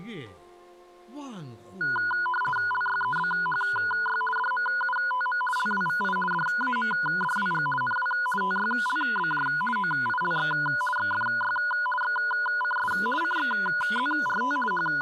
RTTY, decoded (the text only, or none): LYEBHY DMUTM LWVI DAMDWG NW TYLBJ OILX XFY XCS CXZRT …